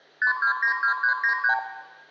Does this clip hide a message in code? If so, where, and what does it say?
Yes: multi-frequency trunk signalling (R2, with the far end's replies) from 0.2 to 1.6 s, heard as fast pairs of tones, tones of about 100 ms, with room echo. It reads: 5292393